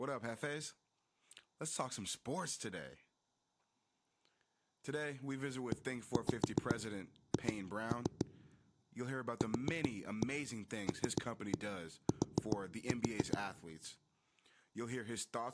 Tap code, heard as knocks on a wall, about 7 knocks a second, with speech in English. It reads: EH QLT